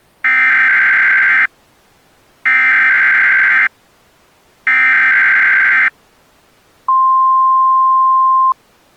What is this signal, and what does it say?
Emergency Alert System (SAME) tones (header bursts, then the 1050 Hz attention tone), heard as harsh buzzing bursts, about 520.83 baud.